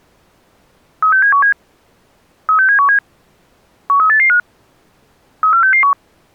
Five-tone selective call (CCIR), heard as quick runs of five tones, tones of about 100 ms. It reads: 36717 36717 13885 34661